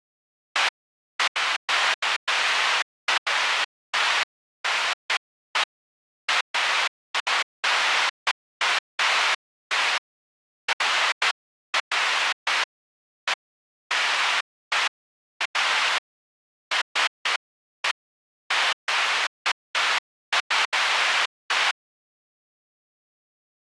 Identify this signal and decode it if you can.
Bursts of noise. There is no code.